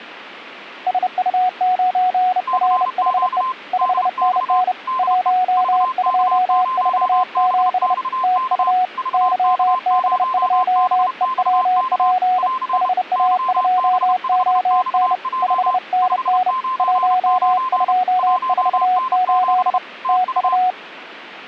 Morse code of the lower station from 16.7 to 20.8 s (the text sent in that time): 1248 TU